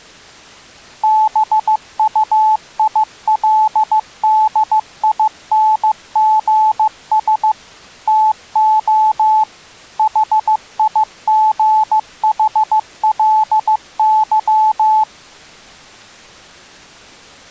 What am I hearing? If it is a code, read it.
Morse code, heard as a keyed tone, machine-sent, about 15 wpm, 870 Hz. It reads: BUILDINGS TO HIGHLY